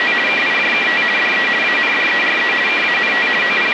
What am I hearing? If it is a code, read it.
RTTY (50 baud, 450 Hz shift), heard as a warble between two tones, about 2150 Hz centre, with radio static. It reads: … KIJKT DE ANDERE KANT …